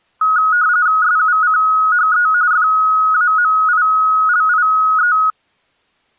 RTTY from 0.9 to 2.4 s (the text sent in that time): SUCHE